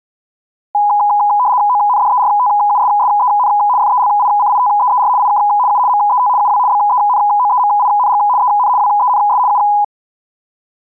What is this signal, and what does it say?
RTTY (75 baud, 170 Hz shift), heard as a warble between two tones, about 910 Hz centre. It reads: ONDERTUSSEN FELICITEER IK U MET UW BENOEMING EN WENS U